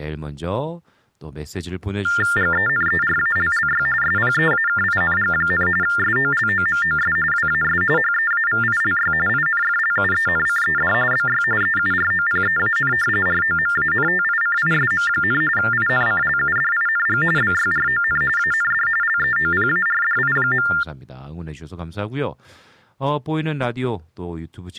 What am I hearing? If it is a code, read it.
TTY/TDD text telephone tones (45.45 baud Baudot), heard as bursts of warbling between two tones, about 400 Hz shift, 1600 Hz centre, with speech in Korean. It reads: GENERALLY SPEAKING, SOLOMOS WAS HEAVILY INFLUENCED BY EUROPEAN ROMANTICISM, INCLUDING BYRON AND LEOPARDI.